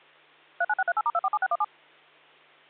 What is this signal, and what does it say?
DTMF, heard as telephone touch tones, dialled by machine, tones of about 40 ms, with hum. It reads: 39638*247617